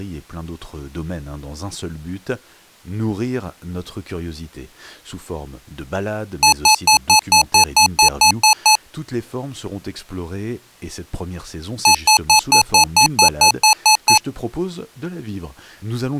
Beep code, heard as beeps from a small speaker, played twice, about 860 Hz, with speech in French. 11 short. In AMI BIOS tables: cache memory error.